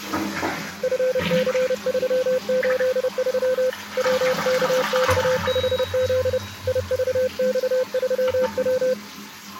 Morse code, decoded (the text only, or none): FC383 WKX5Z IVX3W